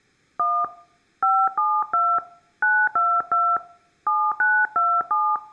DTMF, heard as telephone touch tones, dialled by hand, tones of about 250 ms. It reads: 1 572 922 7927